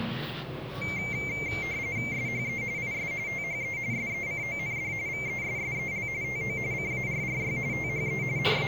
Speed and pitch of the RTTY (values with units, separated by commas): 45.45 baud, 170 Hz shift, 2200 Hz centre